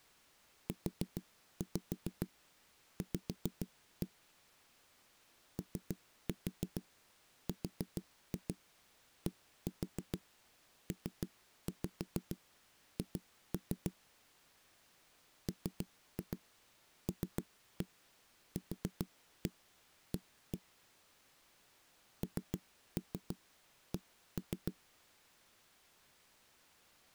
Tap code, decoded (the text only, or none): UV ORDPH MLQA NC